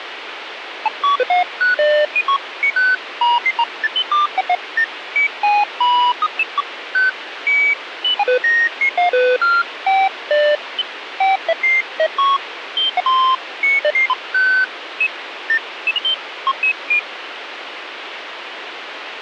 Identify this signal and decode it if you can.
Electronic bleeps of random pitch and length, with radio hiss. There is no code.